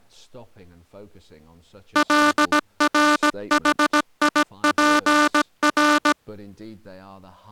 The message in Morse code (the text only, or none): LRHIPR